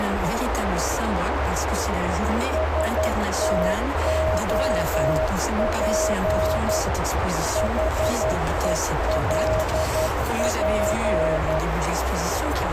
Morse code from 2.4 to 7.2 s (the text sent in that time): STOP